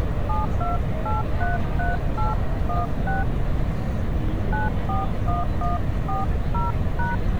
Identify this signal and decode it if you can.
DTMF, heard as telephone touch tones, dialled by hand, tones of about 160 ms, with street noise. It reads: 72833816 941140#